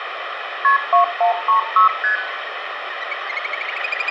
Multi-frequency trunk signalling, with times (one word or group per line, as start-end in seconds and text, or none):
0.6-0.8 KP
0.9-1.9 2136
2.0-2.2 ST